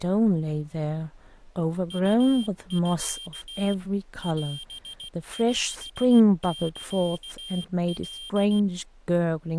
Morse code (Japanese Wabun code), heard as a high beeper, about 16 wpm, 3200 Hz, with speech in English. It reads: ウミ オオサカ